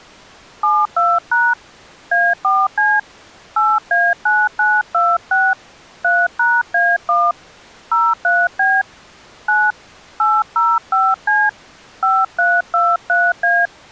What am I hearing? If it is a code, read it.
DTMF, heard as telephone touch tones, dialled by hand, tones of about 220 ms. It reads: 72# A4C 8A9926 3#A1 03B 9 805C 5323A